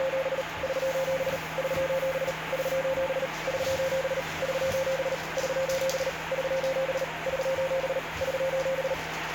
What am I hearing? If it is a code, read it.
Morse code, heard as a keyed tone, machine-sent, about 38 wpm, 530 Hz, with radio static and the noise of a restroom. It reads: … <SOS> <SOS> <SOS> <SOS> <SOS> <SOS> <SOS> <SOS> <SOS>